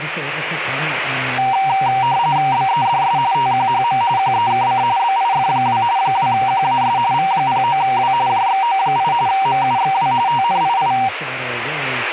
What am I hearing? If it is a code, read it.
RTTY (45.45 baud, 170 Hz shift), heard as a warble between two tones, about 860 Hz centre, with radio static and speech in English. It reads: BEDS TQHM QEKC BIF2 2QAS V09W JXO8 MUXW TNII